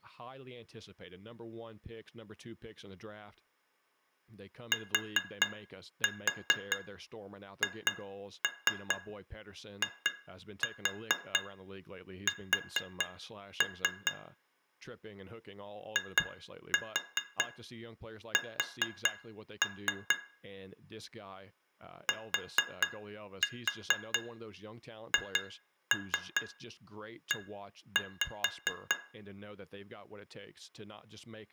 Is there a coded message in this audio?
Yes: tap code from 4.7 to 29.0 s, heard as taps on glass, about 4 knocks a second, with room echo and speech in English. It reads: THIS IS THE